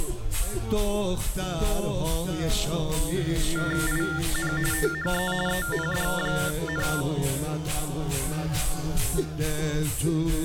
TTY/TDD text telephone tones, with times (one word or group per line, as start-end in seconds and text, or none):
3.9-4.5 IN
4.7-5.3 THE
5.5-6.9 END,